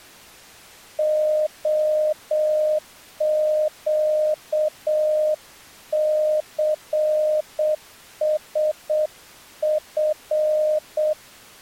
Morse code, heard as a keyed tone, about 7 wpm, 610 Hz. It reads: OQCSF